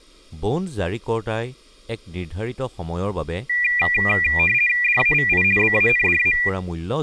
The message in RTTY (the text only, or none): DAVI BANDA